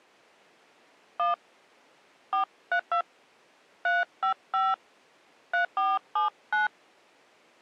DTMF, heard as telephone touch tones, dialled by hand, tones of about 140 ms. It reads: 1 432 355 3479